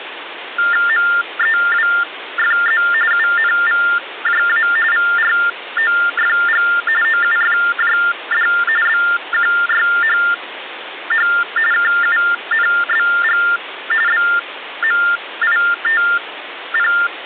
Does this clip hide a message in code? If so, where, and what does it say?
Yes: TTY/TDD text telephone tones (45.45 baud Baudot) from 0.6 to 17.1 s, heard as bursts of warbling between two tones, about 400 Hz shift, 1600 Hz centre, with phone line noise. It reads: MEWFZ UNVJA VROFG OUFJD BQYHH KUNBG BMITP